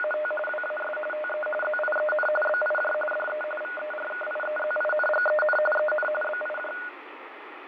RTTY (45.45 baud, 850 Hz shift), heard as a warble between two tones, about 1030 Hz centre, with radio static and fading. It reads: … WAS TE ZIEN BIJ DE VERKIEZINGEN EN BIJ